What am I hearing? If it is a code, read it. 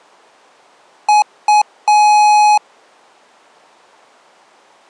Beep code, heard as beeps from a small speaker, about 840 Hz. 2 short, 1 long.